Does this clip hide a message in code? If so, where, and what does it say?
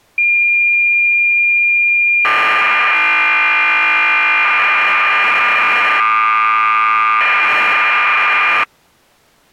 Yes: cassette data (Kansas City type), 1200 baud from 0.2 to 8.6 s, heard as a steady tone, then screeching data.